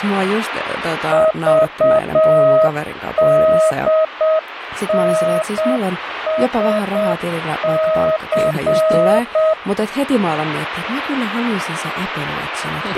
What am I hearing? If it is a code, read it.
Morse code, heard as a keyed tone, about 7 wpm, 630 Hz, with radio static and speech in Finnish. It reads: VDNSC